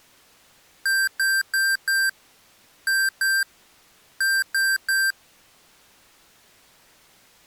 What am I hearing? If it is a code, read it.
Beep code, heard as beeps from a small speaker, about 1600 Hz. 4-2-3. In Phoenix BIOS tables: gate A20 failure.